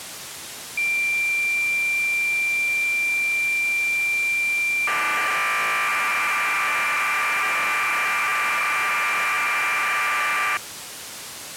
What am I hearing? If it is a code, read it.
Cassette data (Kansas City type), 1200 baud, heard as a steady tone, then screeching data, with tape hiss.